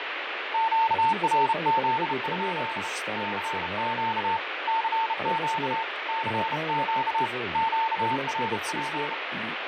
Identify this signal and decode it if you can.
Morse code, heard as a keyed tone, hand-sent with a bug key, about 31 wpm, 900 Hz, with heavy radio static, fading and speech in Polish. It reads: QRZ? CQ CQ CQ QRP